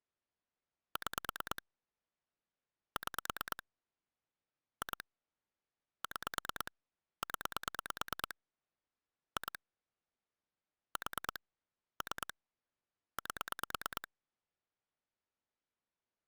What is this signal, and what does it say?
Pulse dialling, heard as clicks on a phone line, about 9 pulses a second. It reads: 6 6 2 6 0 2 4 3 8